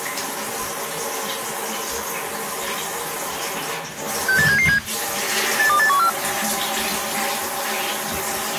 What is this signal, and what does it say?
Five-tone selective call (CCIR), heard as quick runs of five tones, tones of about 100 ms, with the noise of a restroom. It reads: 68777 82814